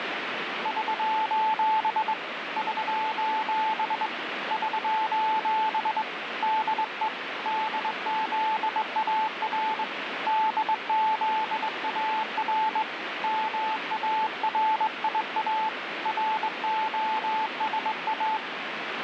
Morse code, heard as a keyed tone, hand-sent with a straight key, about 21 wpm, 870 Hz, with radio static. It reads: <SOS> <SOS> <SOS> DE DZAR DZAR MARIA ROSA